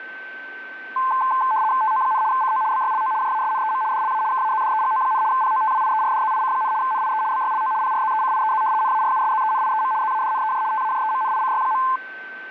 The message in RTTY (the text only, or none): TO, CO BYLO JASNEM DLA KAZDEGO, POTWIERDZIC, NIE BYLO PRZECIEZ NARUSZENIEM ZADNEJ TAJEMNICY.